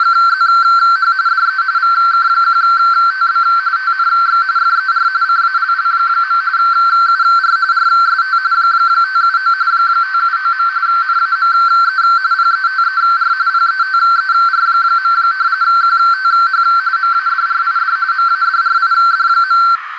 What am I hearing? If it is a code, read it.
RTTY (45.45 baud, 170 Hz shift), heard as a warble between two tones, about 1450 Hz centre, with radio static and a narrow filter. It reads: … DE VK1TB TNX FER CALL. UR RST 579 579. NAME PETER PETER. QTH MADRID MADRID.